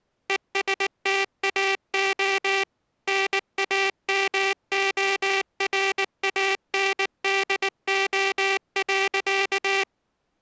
Morse code, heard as a buzzer, machine-sent, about 19 wpm. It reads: ESTAO NAMORANDO.